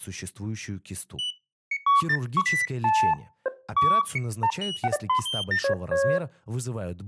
Electronic bleeps of random pitch and length, with speech in Russian. There is no code.